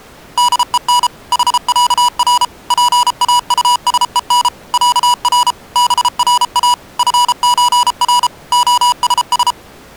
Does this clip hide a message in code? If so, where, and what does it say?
Yes: Morse code (with Swedish letters) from 0.3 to 9.6 s, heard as electronic beeps, machine-sent, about 33 wpm, 980 Hz. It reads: DEN HÄR PAUSEN ÄR BRA FÖR OSS